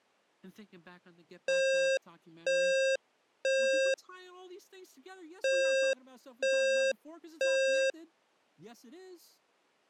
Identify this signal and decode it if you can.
Alarm pattern, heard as an alarm's beeps, played twice, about 530 Hz, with speech in English. Temporal three. Smoke or fire, evacuate.